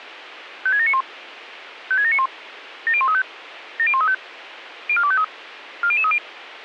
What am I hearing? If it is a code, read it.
Five-tone selective call (ZVEI), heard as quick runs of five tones, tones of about 70 ms, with radio hiss. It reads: 56791 56791 70135 70135 04253 40030